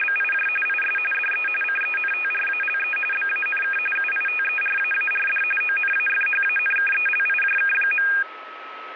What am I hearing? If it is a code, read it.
RTTY (45.45 baud, 850 Hz shift), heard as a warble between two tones, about 2050 Hz centre, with radio static and a steady whistle near 1290 Hz. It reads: … IS DE CENTRALE BANK UITERAARD ONAFHANKELIJK.